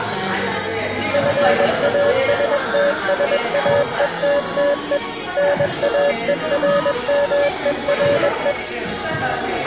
Morse code, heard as a keyed tone, machine-sent, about 21 wpm, 570 Hz, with the noise of a crowd indoors. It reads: FASTSAETTE NAERMERE